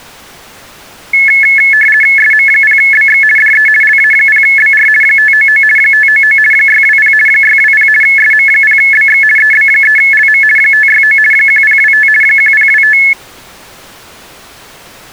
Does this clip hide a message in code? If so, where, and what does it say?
Yes: RTTY (50 baud, 450 Hz shift) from 1.1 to 13.1 s, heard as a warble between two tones, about 1950 Hz centre. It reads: SM0BX DE LA0BR 599 599 620 620 SM0BX EB3LM 569 1025 1025